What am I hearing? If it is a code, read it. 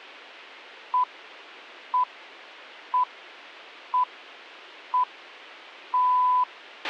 Radio time signal (six pips, as the Greenwich Time Signal), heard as pips, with a squelch burst at the end.